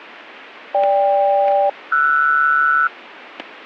Aircraft SELCAL, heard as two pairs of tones, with static crashes. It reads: GK-RS